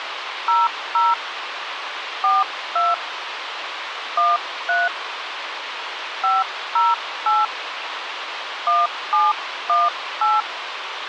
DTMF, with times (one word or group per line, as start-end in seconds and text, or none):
0.5-1.1 00
2.2-2.9 42
4.2-4.9 13
6.2-7.4 508
8.7-10.4 1718